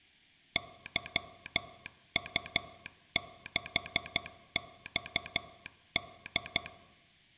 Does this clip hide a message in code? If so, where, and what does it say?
Yes: Morse code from 0.5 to 6.7 s, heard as a telegraph sounder, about 12 wpm. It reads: YU6XD